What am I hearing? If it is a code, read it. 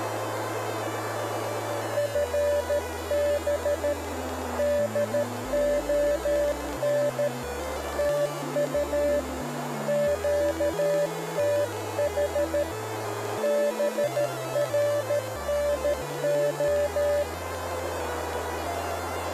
Morse code, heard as a keyed tone, hand-sent with a paddle, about 13 wpm, 580 Hz, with radio static and a narrow filter. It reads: FB DON TU QTH BRNO